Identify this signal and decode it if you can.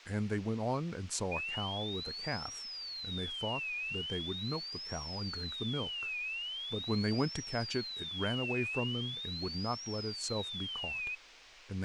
A tone that sweeps in pitch again and again, with phone line noise and speech in English. There is no code.